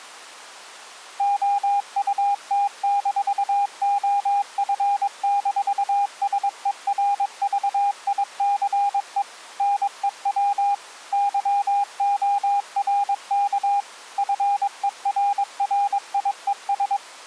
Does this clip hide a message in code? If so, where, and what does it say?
Yes: Morse code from 1.1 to 17.0 s, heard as a keyed tone, machine-sent, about 22 wpm, 810 Hz. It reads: OUT-OF-SERVICE NEW YORK FERRIES